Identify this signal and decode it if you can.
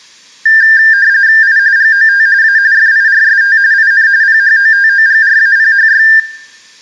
RTTY (45.45 baud, 170 Hz shift), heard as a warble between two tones, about 1700 Hz centre, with room echo. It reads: I GOT A FIRST IN PHOTOGRAPHY